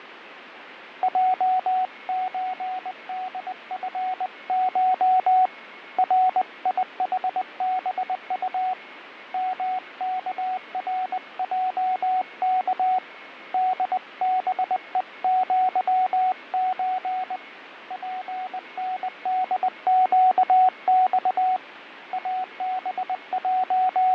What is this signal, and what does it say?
Morse code (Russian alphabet), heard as a keyed tone, hand-sent with a paddle, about 20 wpm, 740 Hz, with radio static, fading and a weaker station near 2180 Hz. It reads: ЙЧДФШ РИХБУ МКРЙК ДБЕЪЧ ПНДЩЬ …